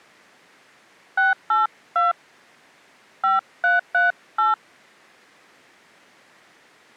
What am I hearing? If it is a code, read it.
DTMF, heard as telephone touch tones, dialled by hand, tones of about 160 ms. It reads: 682 5338